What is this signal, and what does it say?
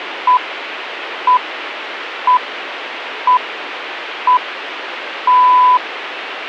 Radio time signal (six pips, as the Greenwich Time Signal), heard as pips, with radio hiss.